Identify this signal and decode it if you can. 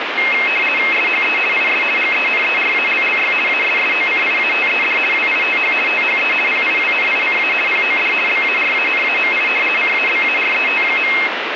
RTTY (50 baud, 450 Hz shift), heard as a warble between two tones, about 2350 Hz centre, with radio static. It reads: SHE IS GENERALLY ASSOCIATED WITH THE PIWNICA POD BARANAMI CABARET.